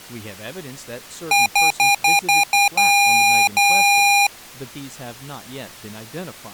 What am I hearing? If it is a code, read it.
Beep code, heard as beeps from a small speaker, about 810 Hz, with speech in English. 6 short, 2 long.